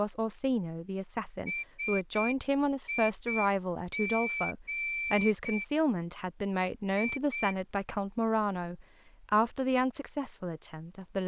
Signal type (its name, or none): Morse code